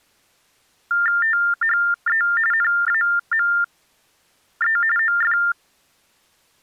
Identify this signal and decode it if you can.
TTY/TDD text telephone tones (45.45 baud Baudot), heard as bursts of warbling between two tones, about 400 Hz shift, 1600 Hz centre. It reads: THE NAME OF